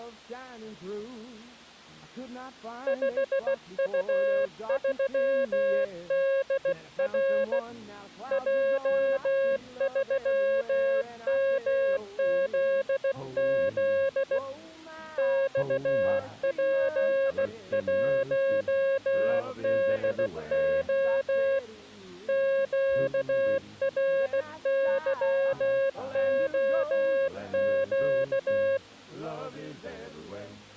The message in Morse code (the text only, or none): 5U3DR J3MZZ XP1DO QRYOQ